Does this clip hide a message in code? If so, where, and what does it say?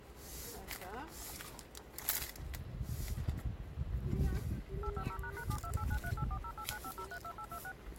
Yes: DTMF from 4.8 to 7.7 s, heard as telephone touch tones, dialled by machine, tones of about 70 ms, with hum and the noise of a residential street. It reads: 850##72893840895032826